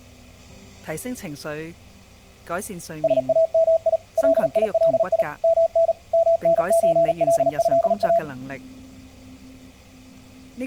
Morse code (Arabic alphabet), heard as a keyed tone, machine-sent, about 38 wpm, 660 Hz. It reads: سامي ليلي من منزلها